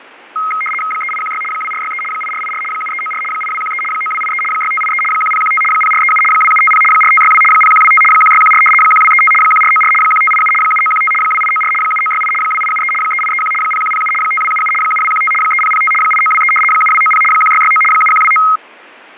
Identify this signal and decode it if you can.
RTTY (75 baud, 850 Hz shift), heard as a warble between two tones, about 1700 Hz centre, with radio static and fading. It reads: 3816 2463 8484 7394 8213 9283 6583 1015 0437 2750 4562 0125 1614 1235 1494 1587 7915 2894 7968 2873 3831 0107 5277 7215 3005 8923 7290 1669 7129